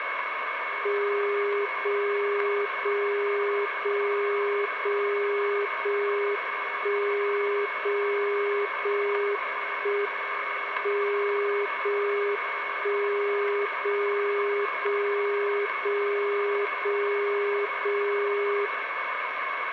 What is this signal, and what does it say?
Radio time signal (JJY), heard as a tone whose level steps once a second, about 410 Hz, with radio static, a steady whistle near 2200 Hz and room echo. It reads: 0 0 0 0 0 1 0 0 1 M 0 1 0 0 0 0 0 0